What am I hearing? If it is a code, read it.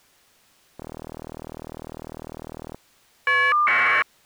Caller ID data burst, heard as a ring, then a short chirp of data, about 1200 baud.